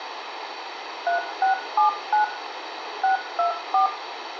DTMF, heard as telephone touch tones, dialled by machine, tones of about 120 ms, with radio hiss and room echo. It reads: 3679 624